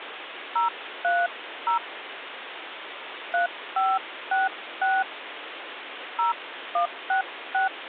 DTMF, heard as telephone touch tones, dialled by hand, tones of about 160 ms, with phone line noise. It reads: 030 3566 0166